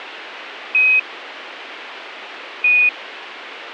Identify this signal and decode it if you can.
Quindar tones, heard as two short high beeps.